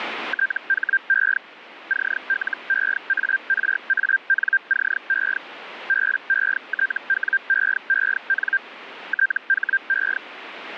Hellschreiber (Feld-Hell, 122.5 baud), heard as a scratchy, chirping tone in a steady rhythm, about 1600 Hz, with radio static. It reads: THE CLEARANCE BETWEEN THE